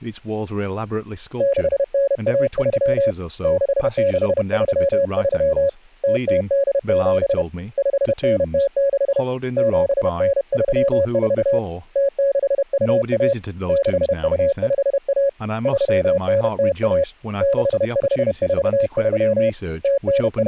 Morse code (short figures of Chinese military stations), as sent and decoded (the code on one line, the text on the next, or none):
-.... -. .- ...-- / -.... -.... ...-- ...-- / - - -.. --... / ..... -. - -.... / --... -. ...-- ....- / - -.... ..- .- / -.... ..- ..... .- / ...-- -. - .- / -.... ..... ....- ...-- / …
6913 6633 0087 5906 7934 0621 6251 3901 6543 …